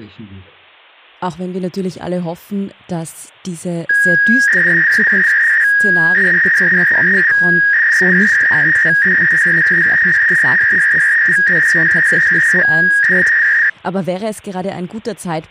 300-baud modem data (V.21 tones), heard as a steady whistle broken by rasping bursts, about 300 baud, 200 Hz shift, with speech in German.